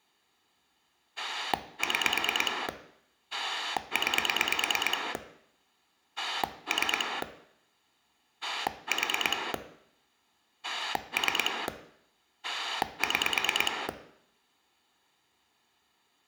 Pulse dialling, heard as a rotary dial, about 9 pulses a second, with room echo. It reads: 6 9 3 4 3 6